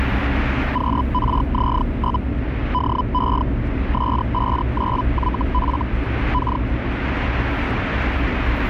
Hellschreiber (Feld-Hell, 122.5 baud), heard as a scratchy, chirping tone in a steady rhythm, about 1000 Hz, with radio static and the noise inside a car. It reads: QRZ? DE S59YF K